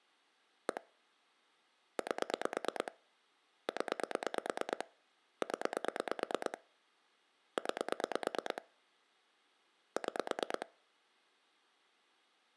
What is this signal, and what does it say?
Pulse dialling, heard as clicks on a phone line, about 9 pulses a second. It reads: 1 8 0 0 9 6